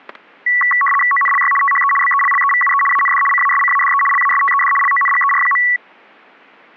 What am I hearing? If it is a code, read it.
RTTY (75 baud, 850 Hz shift), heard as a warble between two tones, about 1550 Hz centre, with static crashes. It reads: ONLY THE BELLEVUE AND CASCADE LASTED LONGER.